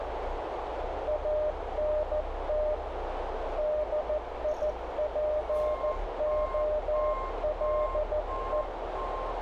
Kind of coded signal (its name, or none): Morse code